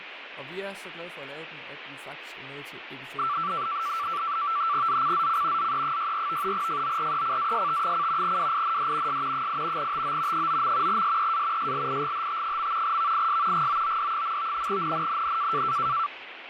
NAVTEX (SITOR-B), 100 baud, 170 Hz shift, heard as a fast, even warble, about 1250 Hz centre, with radio static and speech in Danish. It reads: ZCZC ZE64 FORECAST: WIND S 8 TO 9. SEA SLIGHT. VIS GOOD. NNNN